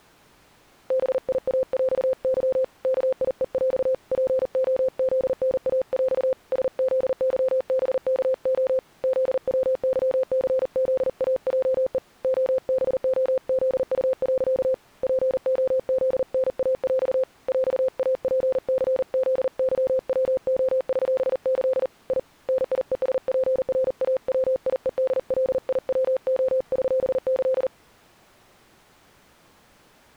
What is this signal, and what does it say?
Morse code (with Polish letters), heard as a keyed tone, hand-sent with a paddle, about 39 wpm, 520 Hz. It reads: BIAŁY KIEŁ POZNAŁ SZYBKO ZWYCZAJE OBOZU. POZNAŁ ŁAPCZYWOŚĆ I NIESPRAWIEDLIWOŚĆ